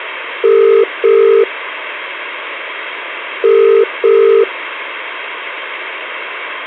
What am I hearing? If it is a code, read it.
Telephone call progress tone (as in the UK, Ireland, Australia and similar networks), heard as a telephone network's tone, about 400, 450 Hz. Ringback tone.